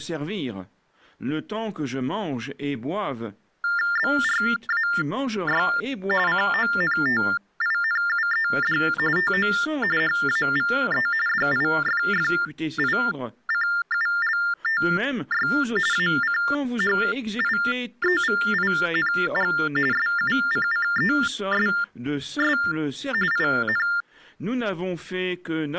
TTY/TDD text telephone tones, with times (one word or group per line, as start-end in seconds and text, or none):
4.0-5.7 BRAY
6.3-8.8 CONTINUED
9.2-9.5 TO
10.0-11.1 HAVE
11.3-15.5 DIFFICULTY
15.9-19.5 ACHIEVING
19.9-22.6 SUCCESS
23.3-23.9 IN